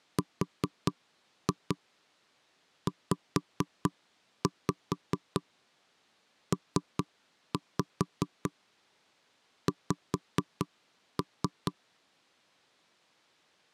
Tap code, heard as knocks on wood, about 4 knocks a second. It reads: RZPX